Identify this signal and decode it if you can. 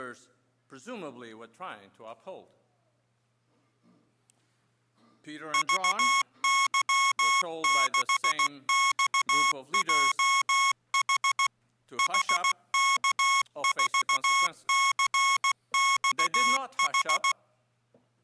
Morse code, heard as electronic beeps, machine-sent, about 16 wpm, 1090 Hz. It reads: VY6XJH HK4CXH